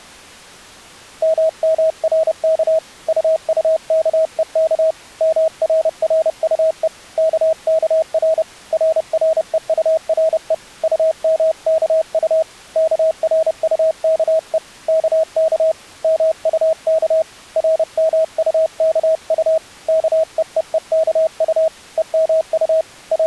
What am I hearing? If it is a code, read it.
Morse code, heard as a keyed tone, hand-sent with a paddle, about 30 wpm, 640 Hz. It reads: MMRK UUKEK MRRUE KKR RREURE UMKU KRUKE KK MUK RMUKU KEEEKU EMU …